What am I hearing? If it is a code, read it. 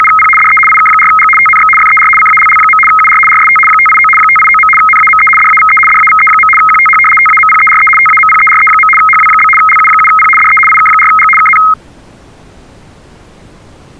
RTTY (75 baud, 850 Hz shift), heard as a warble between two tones, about 1700 Hz centre. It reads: … DE IK4G TNX FER CALL. UR RST 589 589. NAME DAVE DAVE. QTH TAMPERE TAMPERE. HW? LU7P DE IK4G KN